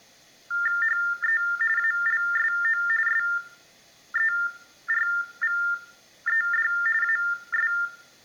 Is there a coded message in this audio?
Yes: TTY/TDD text telephone tones (45.45 baud Baudot) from 0.5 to 7.9 s, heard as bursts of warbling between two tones, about 400 Hz shift, 1600 Hz centre, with room echo. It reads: HE ALSO SERVED AS